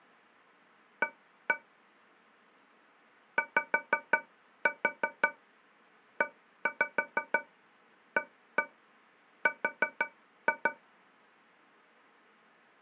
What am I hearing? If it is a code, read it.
Tap code, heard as taps on a metal pipe, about 6 knocks a second. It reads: A YEAR